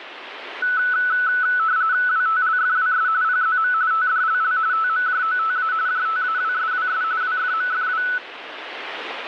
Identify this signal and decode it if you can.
RTTY (45.45 baud, 170 Hz shift), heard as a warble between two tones, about 1400 Hz centre, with radio static. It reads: WTLFWS PZM TDLL TMJOTA JTAWSWS WFMFW